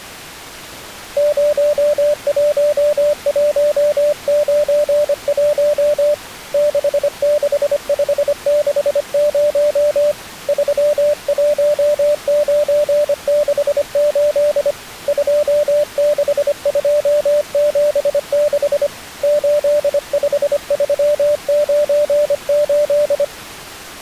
Morse code, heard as a keyed tone, hand-sent with a paddle, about 25 wpm, 590 Hz. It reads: 01191 66560 31968 26276 85398